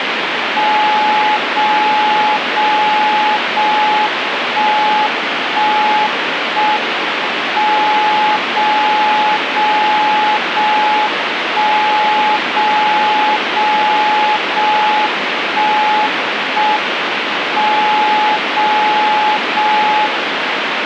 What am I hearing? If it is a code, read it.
Radio time signal (JJY), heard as a tone whose level steps once a second, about 850 Hz, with radio static. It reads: 0 0 0 1 1 1 M 0 0 0 1 0 0 0 1 1 M 0 0 1